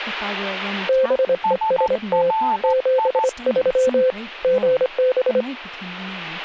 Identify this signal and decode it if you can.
Morse code, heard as two keyed tones, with speech in English. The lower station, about 25 wpm, 520 Hz: BEST 73 GB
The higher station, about 14 wpm, 880 Hz: SRI